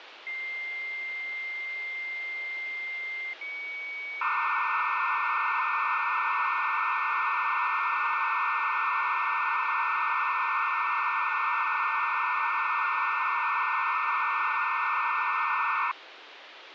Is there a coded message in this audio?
Yes: dial-up modem handshake (low-speed, two carriers) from 0.3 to 15.9 s, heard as two whistles, then hiss, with phone line noise.